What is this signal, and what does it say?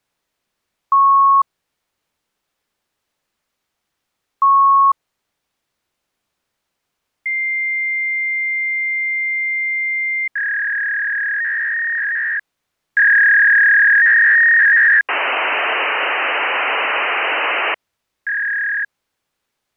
Fax machine handshake, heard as beeps, a long tone, a warble and hiss.